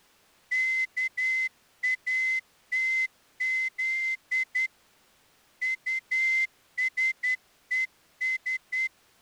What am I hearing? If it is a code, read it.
Morse code, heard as a whistle, hand-sent with a straight key, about 10 wpm. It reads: KATZ USES